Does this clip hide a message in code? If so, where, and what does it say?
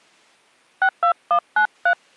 Yes: DTMF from 0.8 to 1.9 s, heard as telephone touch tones, dialled by hand, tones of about 90 ms. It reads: 62193